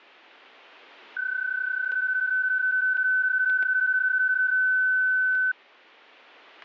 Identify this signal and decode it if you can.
PSK31 (31.25 baud), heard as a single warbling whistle, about 1500 Hz, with static crashes.